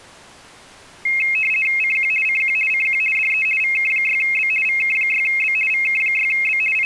RTTY (50 baud, 450 Hz shift), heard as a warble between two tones, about 2350 Hz centre. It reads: CQ CQ CQ DE VK6B VK6B VK6B …